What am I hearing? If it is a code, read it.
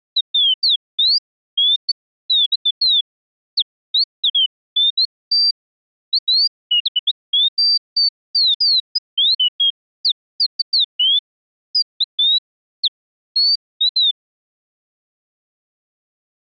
Bird-like chirps. There is no code.